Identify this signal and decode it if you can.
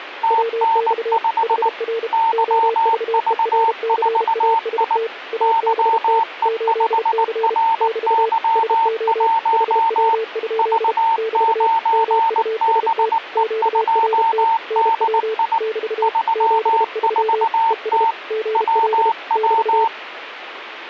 Morse code, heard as two keyed tones, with radio static. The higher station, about 19 wpm, 910 Hz: TN5 YV4I YE5RY1 V9BE2DI 34T WW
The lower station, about 32 wpm, 450 Hz: WX HR OVERCAST ABT 8C <BT> SO HW? <BT> MUST QRT NW <BT> 73 ES GL <BT>